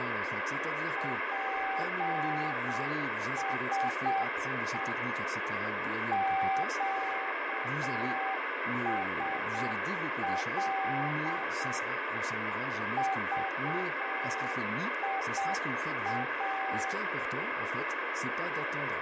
Morse code, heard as a keyed tone, machine-sent, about 7 wpm, 770 Hz, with heavy radio static, fading and speech in French. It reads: PSE QSL VIA